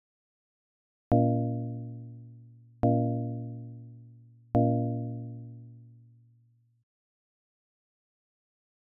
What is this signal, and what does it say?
Clock strike, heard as a bell. 3. Three o'clock.